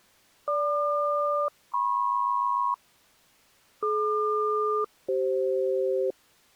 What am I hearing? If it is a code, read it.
Aircraft SELCAL, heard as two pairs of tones. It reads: GQ-MP DQ-CF